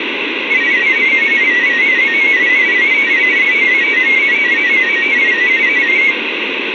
Multi-tone FSK (Olivia or MFSK type), about 500 Hz wide, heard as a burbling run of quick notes, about 31.25 baud, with radio static.